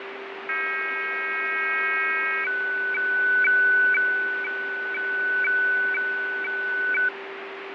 Weather fax (radiofax), 120 lines a minute, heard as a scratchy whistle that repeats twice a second, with radio static, fading and a steady whistle near 390 Hz.